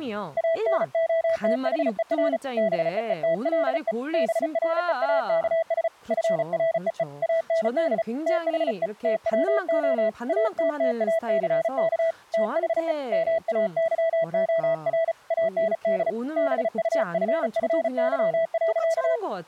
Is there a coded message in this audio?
Yes: Morse code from 0.3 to 19.2 s, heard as a keyed tone, hand-sent with a paddle, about 35 wpm, 660 Hz, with speech in Korean. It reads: ANOTHER BEETLE BREAKS FREE AND THE TWO ATTACK THE MAYOR AND BUFFY.